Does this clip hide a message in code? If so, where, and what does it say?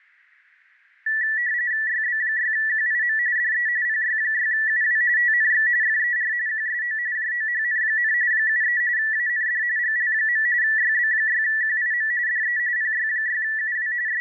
Yes: RTTY (45.45 baud, 170 Hz shift) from 1.1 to 14.2 s, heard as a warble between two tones, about 1850 Hz centre. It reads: YB6QIM DE PY6UW TNX FER QSO JOHN, 73 AND GL. YB6QIM DE PY6UW …